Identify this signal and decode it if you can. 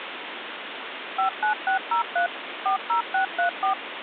DTMF, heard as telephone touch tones, dialled by machine, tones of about 110 ms, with phone line noise. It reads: 59603 40634